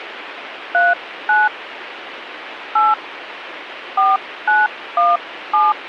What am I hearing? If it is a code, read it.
DTMF, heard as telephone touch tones, dialled by hand, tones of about 190 ms, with radio hiss. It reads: 39 8 4917